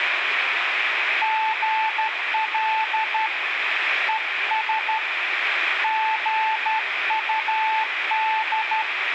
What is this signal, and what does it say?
Morse code, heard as a keyed tone, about 12 wpm, 880 Hz, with radio static and room echo. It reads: GL ES GUD